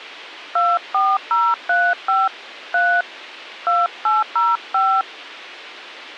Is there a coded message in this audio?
Yes: DTMF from 0.6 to 5.0 s, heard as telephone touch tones, dialled by hand, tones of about 230 ms. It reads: 24035 3 2805